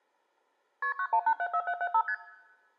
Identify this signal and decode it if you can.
Multi-frequency trunk signalling (R1, as on North American trunks), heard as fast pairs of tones, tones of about 70 ms, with room echo. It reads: KP 91874775 ST